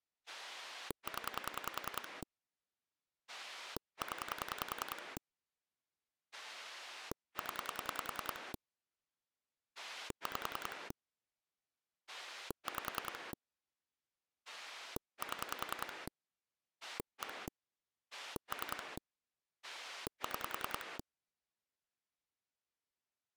Pulse dialling, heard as a rotary dial, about 10 pulses a second. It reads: 0 0 0 5 5 7 1 3 6